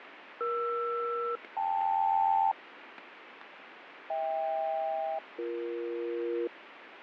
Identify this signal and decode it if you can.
Aircraft SELCAL, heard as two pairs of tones, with radio static and fading. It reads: ER-KL HK-BE